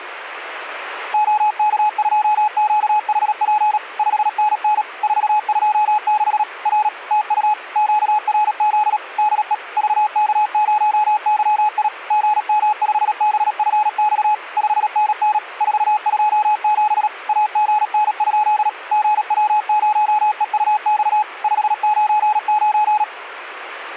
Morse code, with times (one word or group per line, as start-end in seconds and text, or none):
1.1-3.8 OK2QHP
4.0-4.8 5NN
5.0-6.4 426
6.7-6.9 R
7.1-7.5 TU
7.8-9.0 QRZ
9.2-9.5 DE
9.8-11.9 VK0YI
12.1-14.3 GM5BFX
14.6-15.4 5NN
15.6-17.1 427
17.3-18.7 AGN?
18.9-21.2 GW0EUX
21.4-23.0 599